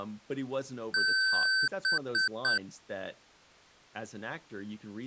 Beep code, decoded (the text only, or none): 1 long, 3 short